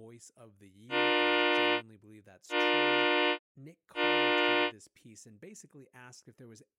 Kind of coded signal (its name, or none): train horn signal